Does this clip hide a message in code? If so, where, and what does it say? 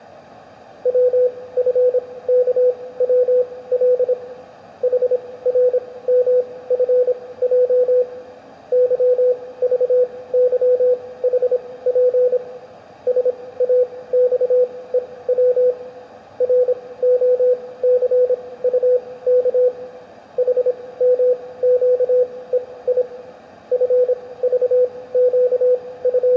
Yes: Morse code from 0.8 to 26.4 s, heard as a keyed tone, machine-sent, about 26 wpm, spaced as for 18 wpm, 500 Hz, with room echo. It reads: WFKWL HRMFJ YVYHP SAXEW ROCUK HMQEI …